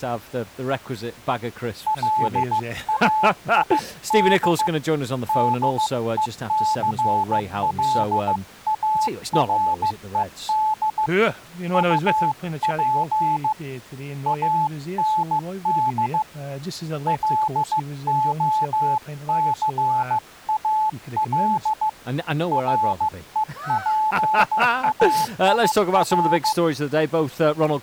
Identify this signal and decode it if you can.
Morse code, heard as a keyed tone, hand-sent with a paddle, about 15 wpm, 860 Hz. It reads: LAID DECLARED UP AND LOCAL REPAIR